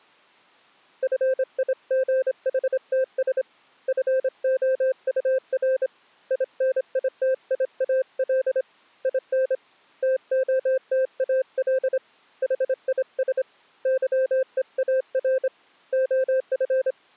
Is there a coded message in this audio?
Yes: Morse code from 1.0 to 17.0 s, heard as a keyed tone, hand-sent with a straight key, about 26 wpm, 520 Hz. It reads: FIGHTS FOUR INITIAL IN TOTAL HIS YEAR OF